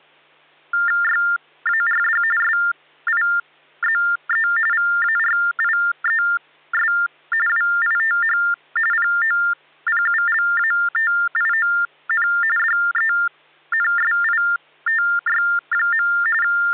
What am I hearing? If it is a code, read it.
TTY/TDD text telephone tones (45.45 baud Baudot), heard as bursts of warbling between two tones, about 400 Hz shift, 1600 Hz centre, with hum. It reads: YARD SIZE VARIES WITH POPULATION DENSITY. …